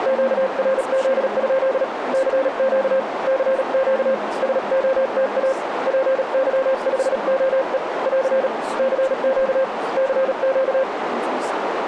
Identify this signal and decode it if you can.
Morse code, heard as a keyed tone, hand-sent with a paddle, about 37 wpm, 530 Hz, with radio static, a narrow filter and speech in English. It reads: QRZ? CQ CQ SOTA PY5OE <AR> CQ CQ